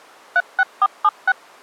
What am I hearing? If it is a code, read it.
DTMF, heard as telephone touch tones, dialled by machine, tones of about 50 ms. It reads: 36476